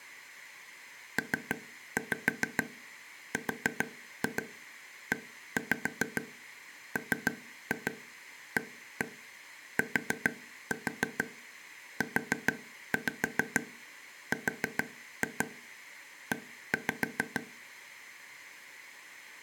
Tap code, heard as taps on a table, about 6 knocks a second, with room echo. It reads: PREMATURE